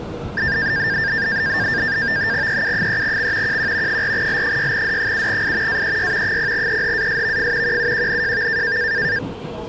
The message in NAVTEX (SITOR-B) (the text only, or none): EU3X QQ 4L6D7I AEY 0EHASVF QUQNJV